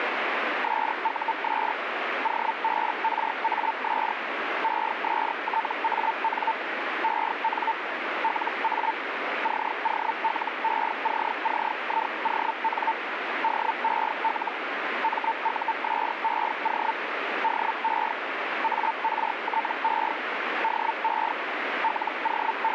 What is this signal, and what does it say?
Hellschreiber (Feld-Hell, 122.5 baud), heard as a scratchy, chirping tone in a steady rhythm, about 900 Hz, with radio static. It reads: SUS OBRAS ESTAN EN LA COLECCION DEL MUSEO DE ARTE DE …